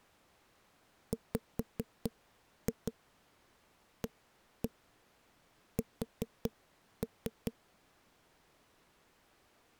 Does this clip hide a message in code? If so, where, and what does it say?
Yes: tap code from 1.1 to 7.5 s, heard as knocks on wood, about 4 knocks a second. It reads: WAS